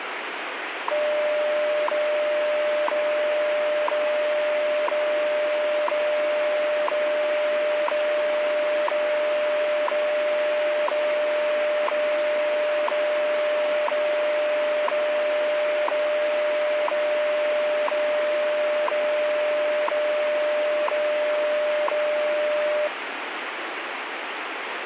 Radio time signal (WWV, Colorado), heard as ticks, one a second, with radio static.